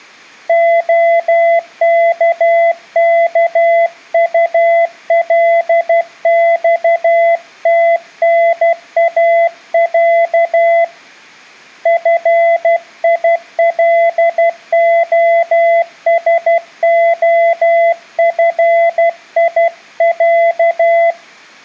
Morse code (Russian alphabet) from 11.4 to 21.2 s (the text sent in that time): ФИЛОСОФИЯ